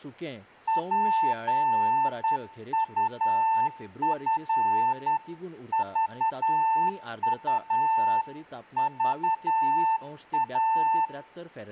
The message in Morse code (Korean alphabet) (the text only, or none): 진리로